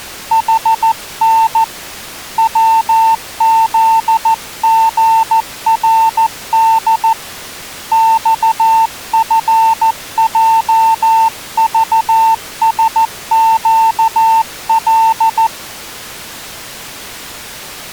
Morse code, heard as a keyed tone, hand-sent with a paddle, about 14 wpm, 900 Hz. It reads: HN WZGRD XFJVSQL